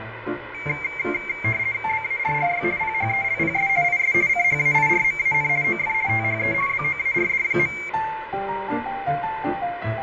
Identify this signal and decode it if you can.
RTTY (50 baud, 170 Hz shift), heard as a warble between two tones, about 2200 Hz centre, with radio static, fading and room echo. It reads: BARRY PHELPS IS CHAIRMAN OF THE BOARD.